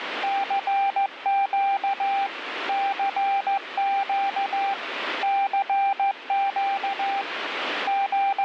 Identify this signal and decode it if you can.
Morse code, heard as a keyed tone, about 15 wpm, 790 Hz, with radio static. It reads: CQ CQ CQ …